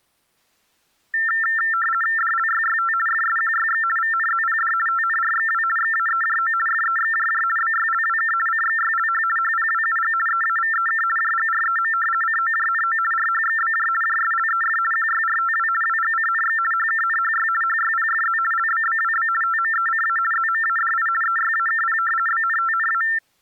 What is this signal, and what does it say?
RTTY (50 baud, 450 Hz shift), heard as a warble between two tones, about 1600 Hz centre. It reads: DLYYT FSQYX VNZPD TNRXW XAEJO FEXJJ BYLWK CXYLH HPWUG EAVEK JGREM COJNO RHXBJ JSLEF QYRTW WGCNX HKNHY HYPFZ LBBWB TMECA ZMADI EYAKP BNTNA